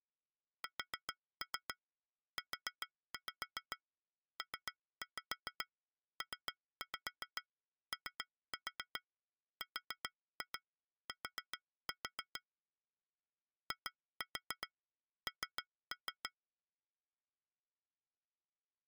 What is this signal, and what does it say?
Tap code, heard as taps on glass, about 7 knocks a second. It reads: SUPPORT IN